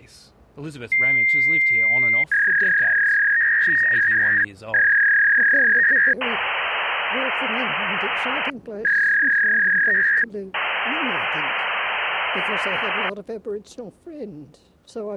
Fax machine handshake, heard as a long tone, a warble and hiss.